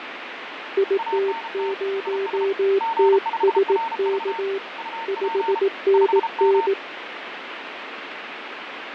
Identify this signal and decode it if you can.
Morse code, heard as two keyed tones, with radio static and fading. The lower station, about 18 wpm, 390 Hz: IT0TSK 5NN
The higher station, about 33 wpm, 910 Hz: ANT IS G5RV UP 5M